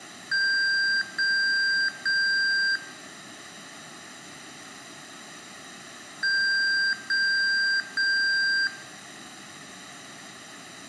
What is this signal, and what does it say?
Beep code, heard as beeps from a small speaker, played twice, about 1600 Hz, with room echo. 3 long. In IBM BIOS tables: keyboard card error.